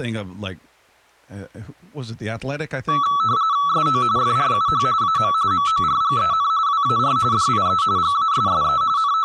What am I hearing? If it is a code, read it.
RTTY (45.45 baud, 170 Hz shift), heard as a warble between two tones, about 1220 Hz centre, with speech in English. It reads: SO FRUH AM MORGEN WAR DIE GASSE …